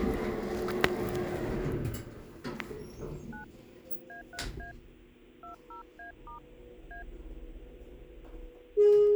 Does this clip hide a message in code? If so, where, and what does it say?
Yes: DTMF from 3.3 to 7.0 s, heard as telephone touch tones, dialled by hand, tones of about 120 ms, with the noise inside a lift. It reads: 9 A3A 20A* A